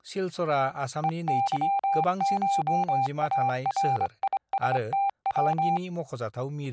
Morse code (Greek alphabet), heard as a keyed tone, hand-sent with a straight key, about 25 wpm, 790 Hz, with speech in Bodo. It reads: ΕΥΧΑΡΙΣΤΩ